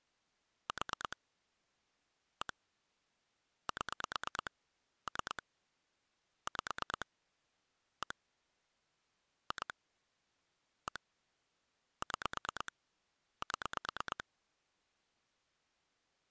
Pulse dialling, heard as clicks on a phone line, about 9 pulses a second. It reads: 4 1 7 3 5 1 2 1 6 7